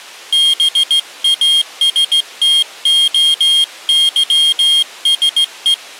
Morse code (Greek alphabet), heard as a high beeper, hand-sent with a straight key, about 16 wpm, 3250 Hz. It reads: ΒΑΣΤΟΥΣΕ